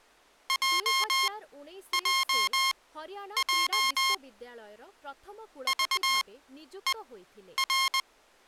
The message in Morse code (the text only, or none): JJJ VER